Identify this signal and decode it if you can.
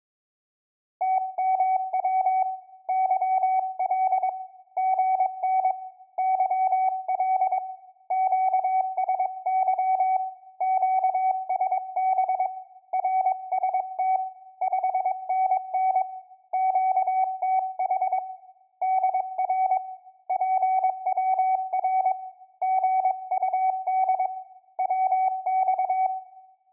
Morse code, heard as a keyed tone, hand-sent with a paddle, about 22 wpm, 760 Hz, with room echo. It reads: TMW YL GN YL QSY QSB RST 5NN QTH DR PWR GUD WX